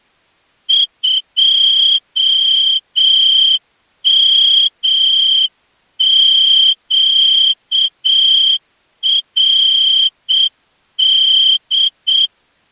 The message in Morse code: 2MQRD

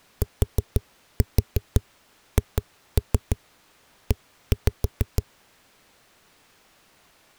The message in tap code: THE

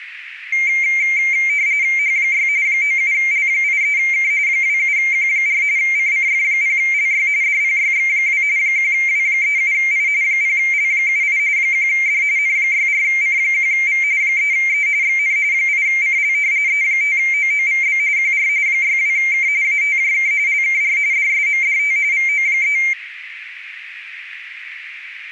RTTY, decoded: H6 97L83K 27Q4 CCF0LY DPYX2 1W37I 0L78 1D N64C1V 3E XN 8CL E5OOVB QR 62K ATJK LKR DSMDT VO3

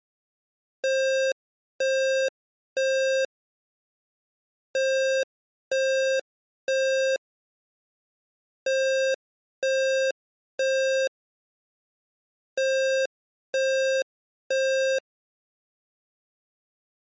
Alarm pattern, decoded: temporal three

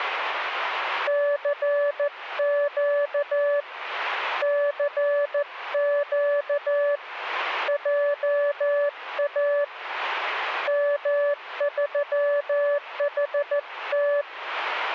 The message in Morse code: CQ CQ JA M3HT

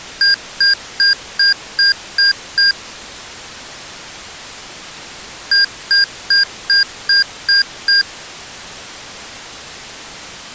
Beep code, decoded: 7 short

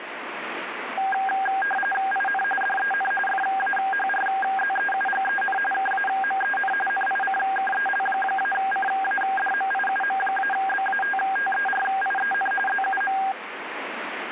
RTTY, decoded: IN DEN FAHRZEUGEN KAMEN NICKEL-CADMIUM-BATTERIEN ZUM

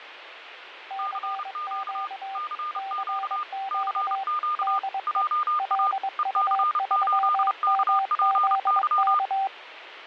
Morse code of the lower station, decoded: CQ CQ DE LU3MZK

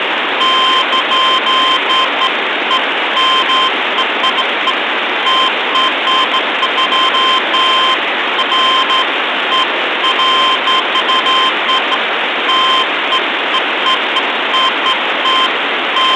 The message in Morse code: none

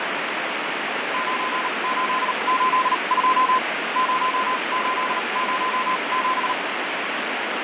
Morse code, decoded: 9882 0807

